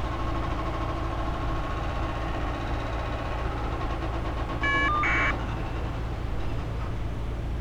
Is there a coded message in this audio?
Yes: caller ID data burst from 2.1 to 5.3 s, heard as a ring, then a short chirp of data, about 1200 baud, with street noise.